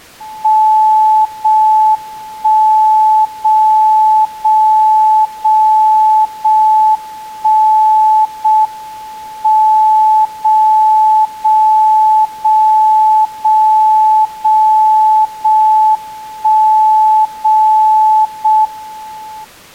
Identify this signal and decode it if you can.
Radio time signal (JJY), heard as a tone whose level steps once a second, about 870 Hz. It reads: 0 1 0 0 0 0 1 0 M 0 0 0 0 0 0 1 0 0 M